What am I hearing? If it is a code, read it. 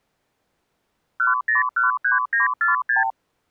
Multi-frequency trunk signalling (R2, with the far end's replies), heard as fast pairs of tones, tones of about 140 ms. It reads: 1013946